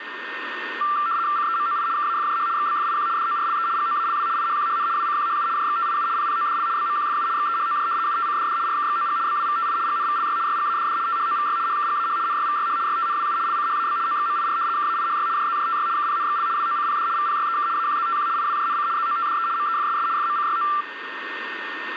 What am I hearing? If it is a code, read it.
RTTY (75 baud, 170 Hz shift), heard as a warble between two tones, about 1260 Hz centre, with radio static and a steady whistle near 1830 Hz. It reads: CEMOI KAFJH XBFIQ DORLE GOALW IHQHN WCQHU JXTIU PPODL BMQFU XEHOJ UTCDD RKXOG BWVTI GNVLY YGADD THOVY HKGAH NYVYH YTNWU LCHAB OXMIR KAIHY JZJTY KPNXL WOCPD VPYEK AQZTQ IWJNC ZOTDE MEFSS FMCYO